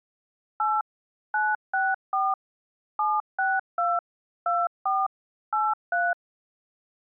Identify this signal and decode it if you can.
DTMF, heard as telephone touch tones, dialled by machine, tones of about 210 ms. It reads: 8 964 762 24 83